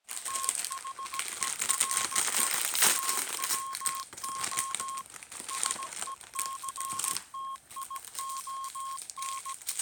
Morse code, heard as a keyed tone, machine-sent, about 17 wpm, 1080 Hz, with kitchen noise. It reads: THERE TWO SECTION